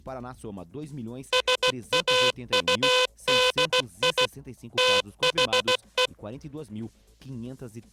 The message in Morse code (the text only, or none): SAUDI THE